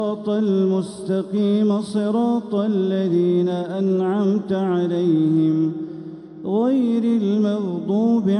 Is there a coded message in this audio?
No.